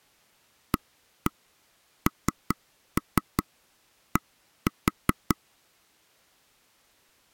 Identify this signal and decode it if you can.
Tap code, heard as taps on a table, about 5 knocks a second. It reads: AND